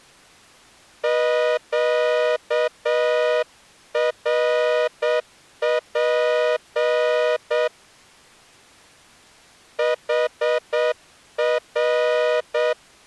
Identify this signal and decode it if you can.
Morse code, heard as a horn, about 7 wpm. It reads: QRP HR